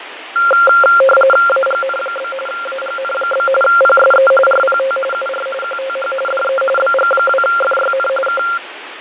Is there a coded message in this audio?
Yes: RTTY (45.45 baud, 850 Hz shift) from 0.4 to 8.6 s, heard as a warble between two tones, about 960 Hz centre, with radio static and fading. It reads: AGN? AGN? PSE RPT UR QTH DE BG2FYN K